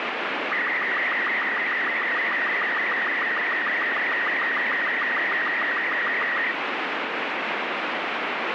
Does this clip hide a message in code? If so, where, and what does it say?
Yes: SSTV (slow-scan television), Robot 36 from 0.5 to 6.5 s, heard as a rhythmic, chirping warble, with heavy radio static.